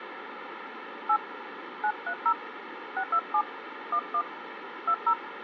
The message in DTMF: 8 930 627 11 20

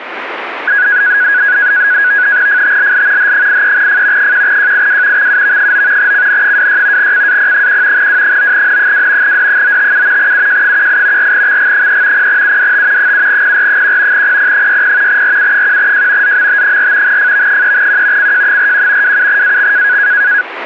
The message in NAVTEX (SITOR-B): FTLL H83F 1JIW XUV9 CN26 CAP1 W9N2 D957 UJ18 4XG3 0UDT 7PR1 PP60 RU1J ZMT4 FV3Q CJ41 27AX

